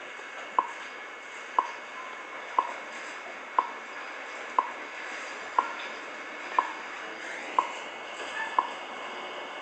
Radio time signal (WWV, Colorado), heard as ticks, one a second, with static crashes, a steady whistle near 2200 Hz, room echo and the noise inside a subway train.